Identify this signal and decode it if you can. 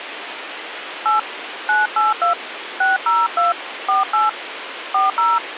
DTMF, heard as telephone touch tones, dialled by hand, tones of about 160 ms, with phone line noise. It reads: 8 982 602 48 40